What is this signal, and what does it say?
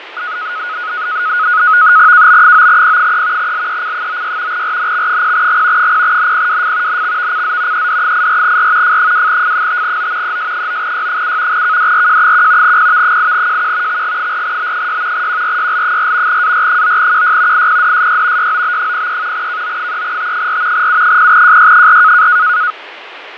NAVTEX (SITOR-B), 100 baud, 170 Hz shift, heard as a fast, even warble, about 1360 Hz centre, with radio static and fading. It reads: KB9P3 LEC96 RNX0G 0NPWF NXVCZ ED84R F2F5O ES9Y7 KDRJ1 PV8JQ XG4B6 QRYL4 AR9QY IPDSY YOB03 KO3T4 U0JY4